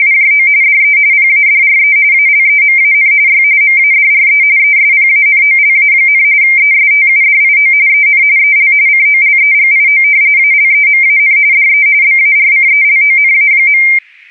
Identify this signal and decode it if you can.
RTTY (45.45 baud, 170 Hz shift), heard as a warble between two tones, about 2200 Hz centre. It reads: … DE PADRE ALEMAN Y MADRE ESPANOLA, ESTUDIO EN EL COLEGIO ALEMAN DE BARCELONA.